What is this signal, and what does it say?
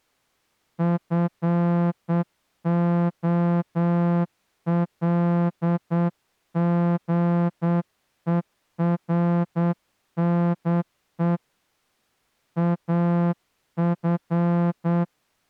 Morse code, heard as a horn, hand-sent with a straight key, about 8 wpm. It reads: FOLGERNE AF